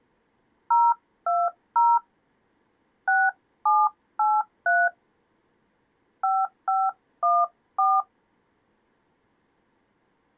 DTMF, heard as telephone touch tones, dialled by hand, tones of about 220 ms. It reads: 020 6783 5514